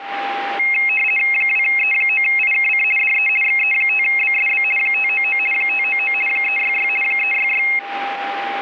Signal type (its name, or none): RTTY